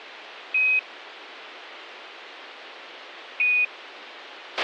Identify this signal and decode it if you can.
Quindar tones, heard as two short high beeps, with a squelch burst at the end.